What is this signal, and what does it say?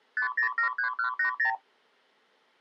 Multi-frequency trunk signalling (R2, with the far end's replies), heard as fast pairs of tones, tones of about 100 ms. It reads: 5073180